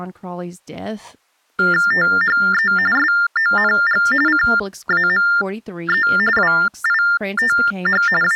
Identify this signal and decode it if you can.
TTY/TDD text telephone tones (45.45 baud Baudot), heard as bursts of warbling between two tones, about 400 Hz shift, 1600 Hz centre, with speech in English. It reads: THE SONG CAME WITH …